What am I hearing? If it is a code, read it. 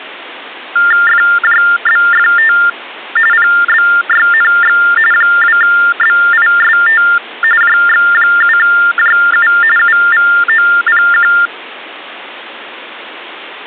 TTY/TDD text telephone tones (45.45 baud Baudot), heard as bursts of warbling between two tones, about 400 Hz shift, 1600 Hz centre. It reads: FJBFT PBYNX 2BIST JX7JU UVOPQ